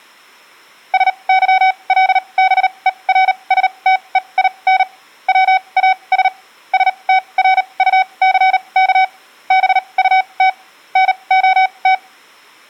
Morse code, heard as a keyed tone, machine-sent, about 38 wpm, spaced as for 27 wpm, 760 Hz. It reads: SYLBERSTEIN WAS STRUCK BUT NOT